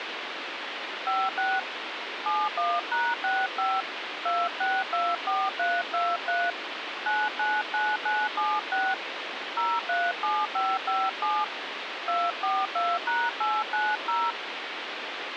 DTMF, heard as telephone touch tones, dialled by hand, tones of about 220 ms, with phone line noise. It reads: 56 71#65 2624323 999976 037557 242#890